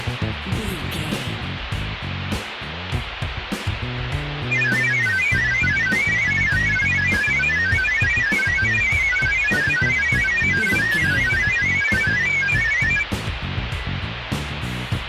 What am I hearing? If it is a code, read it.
Multi-tone FSK (Olivia or MFSK type), about 1000 Hz wide, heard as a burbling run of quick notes, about 31.25 baud, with radio static.